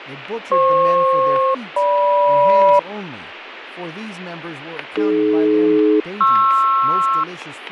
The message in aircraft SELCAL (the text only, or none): FP-GM AD-PR